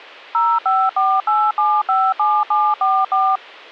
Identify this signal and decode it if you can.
DTMF, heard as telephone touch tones, dialled by machine, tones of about 240 ms. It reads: 0548757744